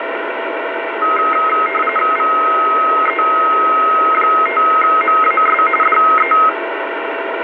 RTTY (45.45 baud, 850 Hz shift), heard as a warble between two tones, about 1700 Hz centre, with radio static. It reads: VE5MAS DE